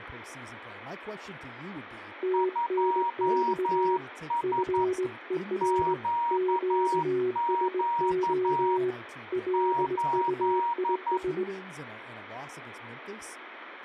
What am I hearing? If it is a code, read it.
Morse code, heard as two keyed tones, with radio static and speech in English. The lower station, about 19 wpm, 370 Hz: TNX FER QSO LUIS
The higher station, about 11 wpm, 940 Hz: 2S QQ 8